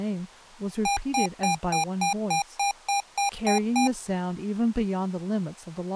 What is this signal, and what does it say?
Beep code, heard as beeps from a small speaker, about 800 Hz, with speech in English. 11 short. In AMI BIOS tables: cache memory error.